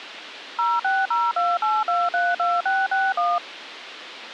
DTMF, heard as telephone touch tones, dialled by machine, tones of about 210 ms, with radio hiss. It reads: 06028232661